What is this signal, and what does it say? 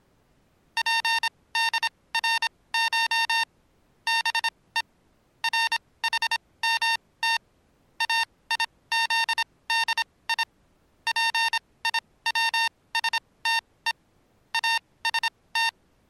Morse code (Persian alphabet), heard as electronic beeps, machine-sent, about 26 wpm, spaced as for 19 wpm, 910 Hz. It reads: پدرش به رحمت ایزدی پیوسته است